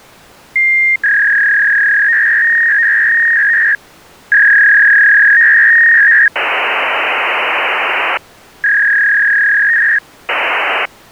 Fax machine handshake, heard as a long tone, a warble and hiss.